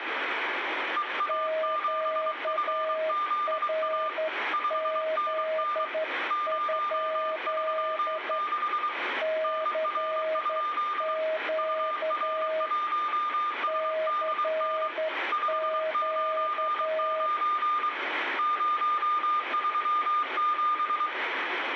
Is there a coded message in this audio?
Yes: Morse code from 0.9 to 21.1 s, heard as two keyed tones, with radio static and room echo. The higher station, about 23 wpm, 1200 Hz: EA7FZA 5NN 036 NR? UR1SDN 599 037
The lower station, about 11 wpm, 630 Hz: QRZ? CQ CQ